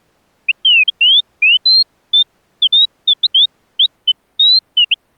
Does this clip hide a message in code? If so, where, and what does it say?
No, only bird-like chirps.